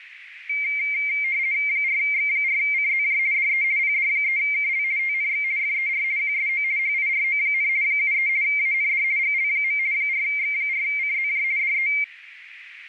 RTTY (50 baud, 170 Hz shift), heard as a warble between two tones, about 2200 Hz centre, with radio static and a narrow filter. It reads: 4X4CZJ DE PD3KL TNX FER QSO HIRO, 73 AND GL. 4X4CZJ DE